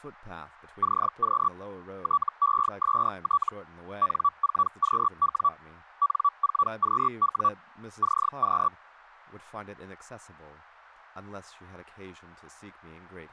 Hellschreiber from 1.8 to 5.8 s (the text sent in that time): TEST N4QW